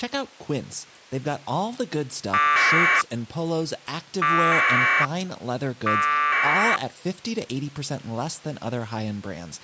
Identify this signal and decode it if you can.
Packet radio (AX.25, as in APRS), 1200 baud, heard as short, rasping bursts, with speech in English.